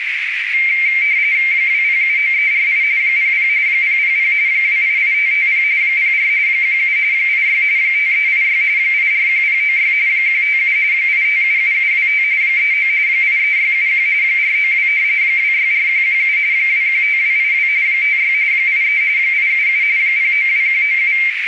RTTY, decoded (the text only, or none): 2079348 00 000 288550 04 17 86 5386 841096 157 8577725 39 83671 492 264117 215282 56 83 877 092197